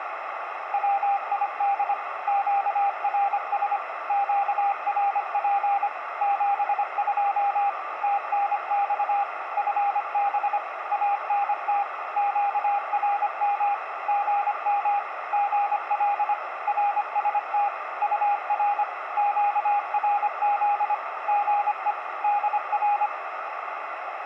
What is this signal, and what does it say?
Morse code, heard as a keyed tone, machine-sent, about 25 wpm, 810 Hz, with radio static and a narrow filter. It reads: WID QRS QRP 72 TNX FB ANT QRM GM GL RST UR QRZ GE DR